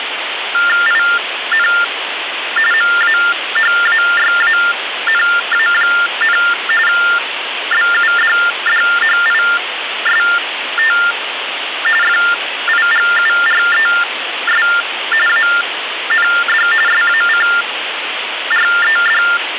TTY/TDD text telephone tones (45.45 baud Baudot), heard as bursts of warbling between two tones, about 400 Hz shift, 1600 Hz centre, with phone line noise. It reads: IN MAHAYANA, BUDDHIST FIGURES AND SACRED